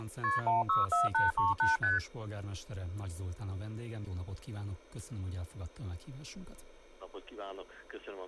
Multi-frequency trunk signalling (R1, as on North American trunks), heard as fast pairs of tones, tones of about 160 ms. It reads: KP 164838 ST